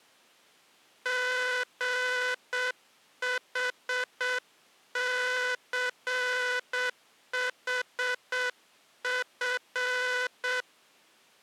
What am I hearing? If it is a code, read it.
Morse code, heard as a buzzer, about 7 wpm. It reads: GHCHF